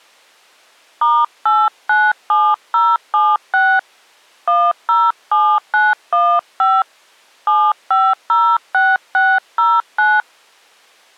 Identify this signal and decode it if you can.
DTMF, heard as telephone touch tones, dialled by hand, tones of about 230 ms. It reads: *897076 107915 7506609